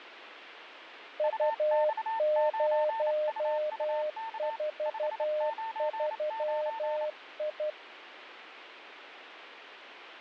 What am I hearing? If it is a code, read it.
Morse code, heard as two keyed tones, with radio static. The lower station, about 12 wpm, 610 Hz: U043I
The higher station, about 28 wpm, 900 Hz: UX9UUK 599